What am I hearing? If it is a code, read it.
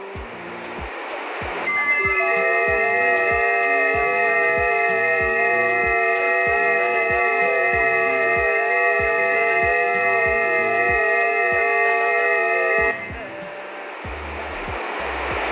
FT8 (several signals at once), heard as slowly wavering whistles, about 6.25 baud, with radio static and room echo.